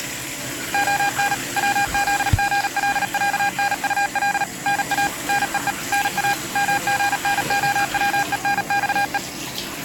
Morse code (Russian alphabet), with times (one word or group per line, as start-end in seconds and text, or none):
0.7-1.3 ОН
1.6-4.4 ВЗГЛЯНУЛ
4.7-5.1 НА
5.3-5.7 НЕЕ
5.9-6.3 НА
6.6-9.2 МГНОВЕНЬЕ